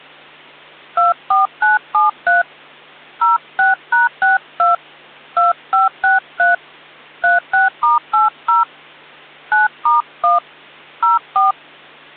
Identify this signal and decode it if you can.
DTMF, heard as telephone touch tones, dialled by hand, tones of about 150 ms, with hum. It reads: 24973 06#62 2563 36*80 9*1 04